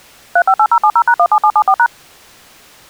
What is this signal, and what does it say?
DTMF, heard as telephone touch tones, dialled by machine, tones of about 70 ms. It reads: 358070#17774#